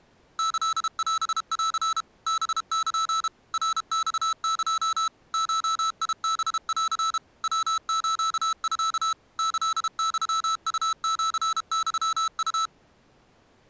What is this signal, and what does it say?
Morse code (Japanese Wabun code), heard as electronic beeps, machine-sent, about 32 wpm, 1320 Hz. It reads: キオン ハル ナマエ ゴハン ヤスミ キユウシユウ